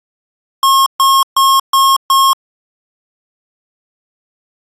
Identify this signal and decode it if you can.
Beep code, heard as beeps from a small speaker, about 1080 Hz. 5 short. In AMI BIOS tables: processor failure; in Dell tables: CMOS battery failure.